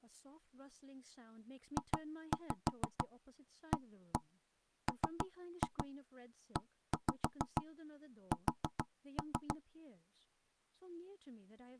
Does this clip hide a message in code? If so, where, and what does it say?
Yes: tap code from 1.8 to 9.6 s, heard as knocks on wood, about 6 knocks a second, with speech in English. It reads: JAMES